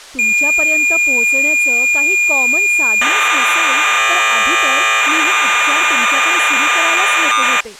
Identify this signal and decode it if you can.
Cassette data (Kansas City type), 1200 baud, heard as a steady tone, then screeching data, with speech in Marathi.